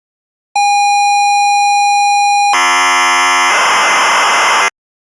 ZX Spectrum tape loading, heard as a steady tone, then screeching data.